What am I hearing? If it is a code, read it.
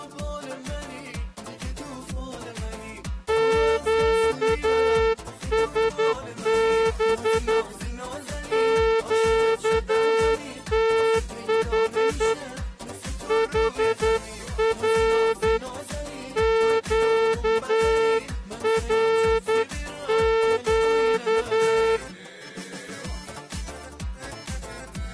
Morse code, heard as a horn, hand-sent with a straight key, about 10 wpm. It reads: QSB QTH HR QRQ